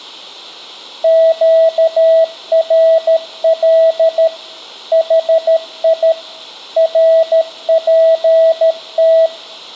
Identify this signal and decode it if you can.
Morse code, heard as a keyed tone, machine-sent, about 13 wpm, 650 Hz, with room echo. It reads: QRL HI RPT